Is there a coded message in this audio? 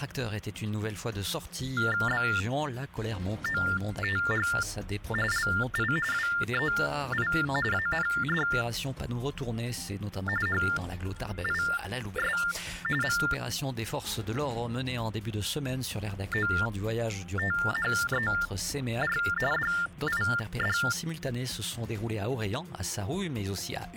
Yes: TTY/TDD text telephone tones (45.45 baud Baudot) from 1.8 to 20.9 s, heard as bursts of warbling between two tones, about 400 Hz shift, 1600 Hz centre. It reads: BOTH LI WEI AND HIS MOTHER DID